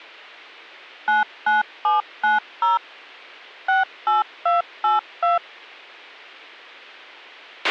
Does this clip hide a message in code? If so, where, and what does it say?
Yes: DTMF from 1.1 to 5.4 s, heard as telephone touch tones, dialled by machine, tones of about 150 ms, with a squelch burst at the end. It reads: 99790 68282